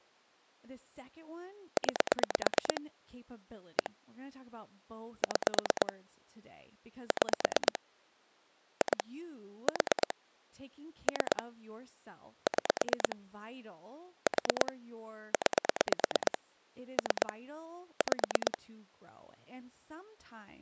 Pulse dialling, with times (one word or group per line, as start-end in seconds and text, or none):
1.8-2.8 9
3.8-3.9 1
5.2-5.9 6
7.1-7.8 6
8.8-9.0 2
9.7-10.1 4
11.1-11.4 3
12.5-13.2 6
14.3-14.7 4
15.3-16.4 9
17.0-17.3 3
18.0-18.6 5